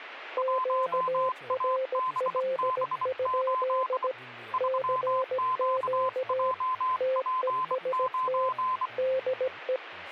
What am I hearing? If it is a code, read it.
Morse code, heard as two keyed tones, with radio static and speech in Bodo. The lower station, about 17 wpm, 520 Hz: QRL? CQ TEST DE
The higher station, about 24 wpm, 1030 Hz: 1ABB8 3QJP9